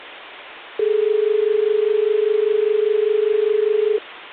Telephone call progress tone (as in Australia), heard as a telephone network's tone, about 430 Hz, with phone line noise. Dial tone.